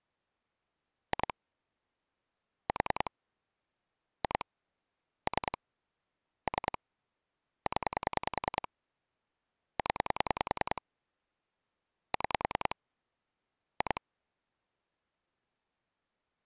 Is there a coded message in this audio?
Yes: pulse dialling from 1.1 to 14.0 s, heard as clicks on a phone line, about 10 pulses a second. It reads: 2 4 2 3 3 0 0 6 2